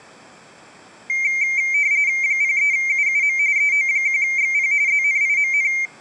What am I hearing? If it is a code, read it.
RTTY (45.45 baud, 170 Hz shift), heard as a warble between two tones, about 2200 Hz centre. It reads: 03UUM EO1XP ZNIMN